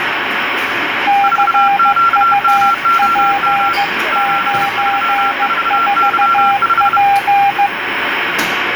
Morse code, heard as two keyed tones, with radio static and the noise of a cafe. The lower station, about 15 wpm, 800 Hz: CUP94P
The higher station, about 31 wpm, 1360 Hz: 4QMOM 734Y5